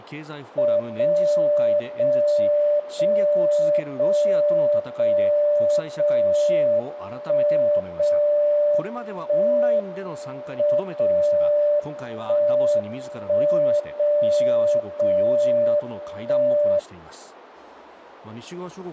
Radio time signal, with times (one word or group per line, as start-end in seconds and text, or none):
0.8-1.8 0
1.8-2.8 0
2.8-3.8 0
3.8-4.8 0
4.8-5.8 0
5.8-6.8 0
6.8-7.8 1
7.8-8.8 0
8.8-9.8 1
9.8-10.8 M
10.8-11.8 0
11.8-12.8 1
12.8-13.8 1
13.8-14.8 0
14.8-15.8 0
15.8-16.8 1